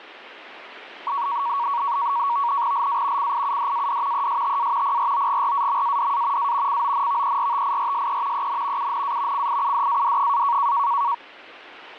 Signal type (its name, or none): NAVTEX (SITOR-B)